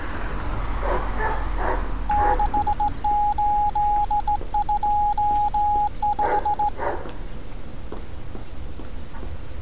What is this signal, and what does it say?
Morse code, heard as a keyed tone, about 17 wpm, 830 Hz, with street noise. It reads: 6825